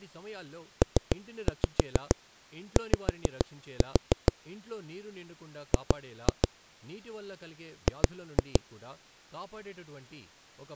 Tap code, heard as knocks on a wall, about 6 knocks a second, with speech in Telugu. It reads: PY G G